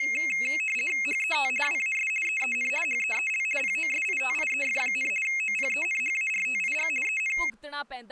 RTTY (50 baud, 450 Hz shift), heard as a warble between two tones, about 2350 Hz centre, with speech in Punjabi. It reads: HET WAS EEN HEEL POSITIEF, OPENHARTIG EN